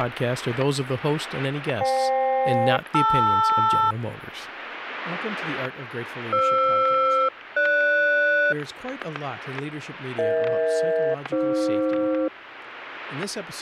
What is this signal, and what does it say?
Aircraft SELCAL, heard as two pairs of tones, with static crashes and speech in English. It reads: FK-LR FR-GS EH-AF